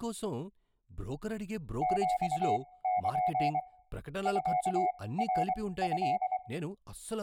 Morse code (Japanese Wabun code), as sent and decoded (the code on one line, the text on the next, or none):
--..- -.--. / ..-.- .-. ..-..
ヒル ミナト